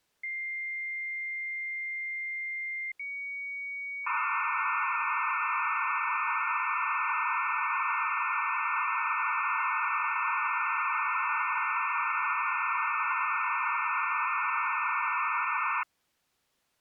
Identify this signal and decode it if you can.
Dial-up modem handshake (low-speed, two carriers), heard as two whistles, then hiss.